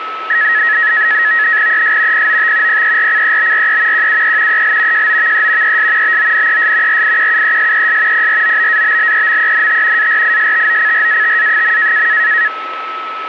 NAVTEX (SITOR-B), 100 baud, 170 Hz shift, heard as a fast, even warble, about 1800 Hz centre, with radio static and a steady whistle near 1300 Hz. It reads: ES POT PERCEBRE QUE EL JOVE ES BONES RIQUESES PROBABLEMENT ARISTOCRATA.